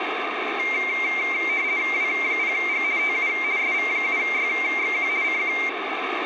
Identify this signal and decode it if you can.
RTTY (50 baud, 170 Hz shift), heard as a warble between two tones, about 2200 Hz centre, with radio static. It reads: W0G TU SV7YXQ CQ